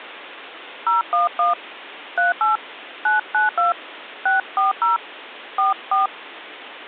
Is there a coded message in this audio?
Yes: DTMF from 0.9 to 6.1 s, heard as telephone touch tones, dialled by hand, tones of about 150 ms. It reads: 011 38 992 640 44